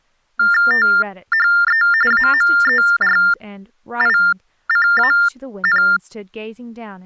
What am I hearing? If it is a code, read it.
TTY/TDD text telephone tones (45.45 baud Baudot), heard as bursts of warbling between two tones, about 400 Hz shift, 1600 Hz centre, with speech in English. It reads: THE AMERICAN